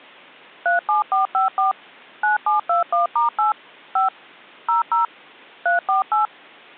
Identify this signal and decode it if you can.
DTMF, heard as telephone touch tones, dialled by machine, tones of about 140 ms. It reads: 37454 9721*8 5 00 348